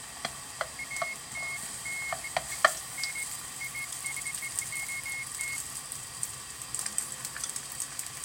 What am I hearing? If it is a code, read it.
Beeps of irregular length, with kitchen noise. There is no code.